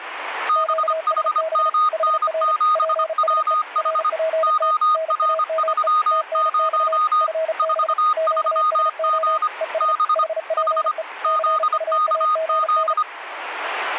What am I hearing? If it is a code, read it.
Morse code, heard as two keyed tones, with radio static. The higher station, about 25 wpm, 1240 Hz: BHMN7WH OR30 43G B H ZKZ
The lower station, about 35 wpm, 640 Hz: QSB HR PSE RPT NAME TNX FB QSO ES HPE CUAGN